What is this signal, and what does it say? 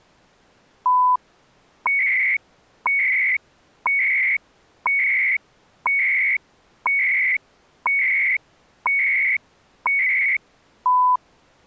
Radio time signal (CHU, Canada), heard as beeps and data bursts, one a second.